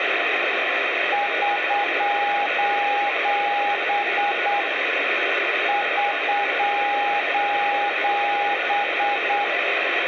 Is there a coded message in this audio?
Yes: Morse code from 1.1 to 9.5 s, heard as a keyed tone, hand-sent with a straight key, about 8 wpm, 820 Hz, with radio static and room echo. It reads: <SOS> <SOS>